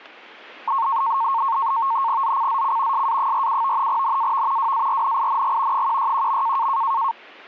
NAVTEX (SITOR-B), 100 baud, 170 Hz shift, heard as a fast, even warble, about 1000 Hz centre. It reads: ZCZC SA47 NAV WARNING 161.